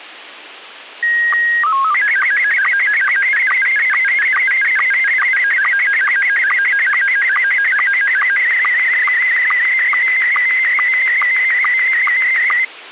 SSTV (slow-scan television), Scottie S1, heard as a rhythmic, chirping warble, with radio hiss.